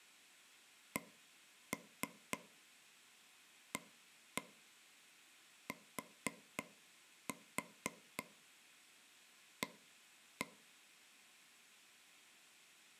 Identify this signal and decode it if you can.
Tap code, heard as taps on a table, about 4 knocks a second, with room echo. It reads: CATA